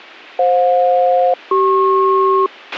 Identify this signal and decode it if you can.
Aircraft SELCAL, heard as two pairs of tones, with a squelch burst at the end. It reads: FJ-CP